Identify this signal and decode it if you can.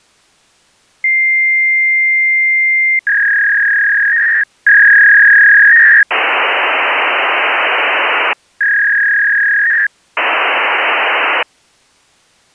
Fax machine handshake, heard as a long tone, a warble and hiss.